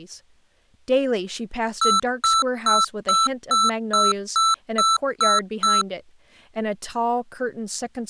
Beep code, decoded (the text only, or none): 10 short